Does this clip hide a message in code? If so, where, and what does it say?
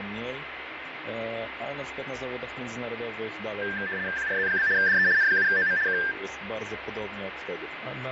Yes: RTTY (75 baud, 170 Hz shift) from 3.6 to 6.1 s, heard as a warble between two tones, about 1700 Hz centre, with radio static, fading and a steady whistle near 2060 Hz. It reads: QRZ? DE N7OM K